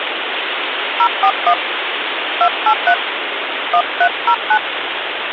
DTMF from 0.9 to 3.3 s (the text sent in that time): 041 283